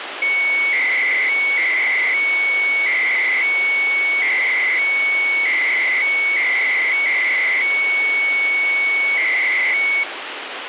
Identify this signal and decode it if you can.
300-baud modem data (Bell 103 tones), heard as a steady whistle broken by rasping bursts, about 300 baud, 200 Hz shift, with phone line noise.